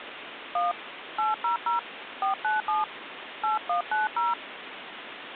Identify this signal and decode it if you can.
DTMF, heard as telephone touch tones, dialled by hand, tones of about 140 ms, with phone line noise. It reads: 1 800 497 8190